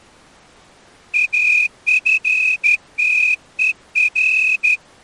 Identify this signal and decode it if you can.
Morse code, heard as a whistle, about 12 wpm. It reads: AFTER